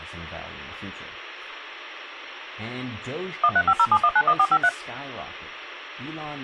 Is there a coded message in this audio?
Yes: DTMF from 3.4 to 4.7 s, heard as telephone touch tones, dialled by machine, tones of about 60 ms, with speech in English. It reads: 13507191453